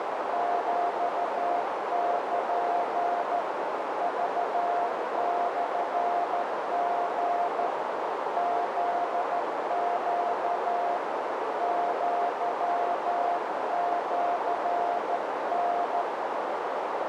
Morse code (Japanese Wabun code), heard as a keyed tone, hand-sent with a straight key, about 13 wpm, 700 Hz, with heavy radio static and a narrow filter. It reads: ヒル クモリ フネ アシタ